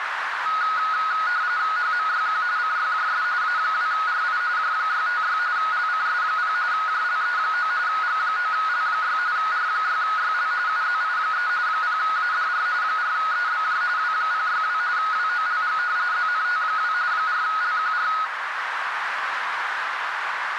RTTY (45.45 baud, 170 Hz shift), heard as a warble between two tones, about 1360 Hz centre, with radio static and a narrow filter. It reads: HMYQ CYJS A2RI J656 LCS0 JLE9 G9L6 R6YL UZI3 0ADR 4EBJ W062 WOLG ZNT2 4LQR